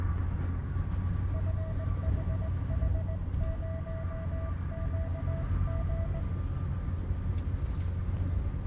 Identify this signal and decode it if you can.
Morse code, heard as a keyed tone, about 19 wpm, 650 Hz, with room echo and the noise inside a car. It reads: FHH0QG